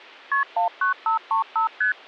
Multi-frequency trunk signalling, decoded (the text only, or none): KP 19535 ST